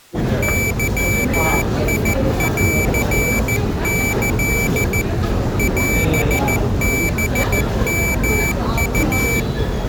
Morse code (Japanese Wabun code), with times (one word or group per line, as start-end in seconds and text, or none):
0.4-5.0 ゲンキ
5.6-9.4 オハヨウ